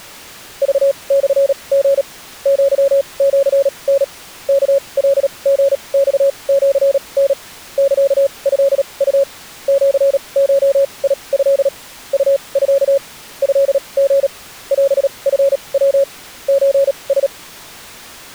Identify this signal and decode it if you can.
Morse code (Japanese Wabun code), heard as a keyed tone, machine-sent, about 37 wpm, spaced as for 27 wpm, 550 Hz. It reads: クモリ アシタ ワカリマシタ サトウ シゴト ウミ トリ オチヤ ソラ